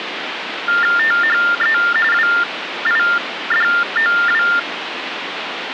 TTY/TDD text telephone tones (45.45 baud Baudot), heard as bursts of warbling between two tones, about 400 Hz shift, 1600 Hz centre, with phone line noise. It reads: THE WIDOW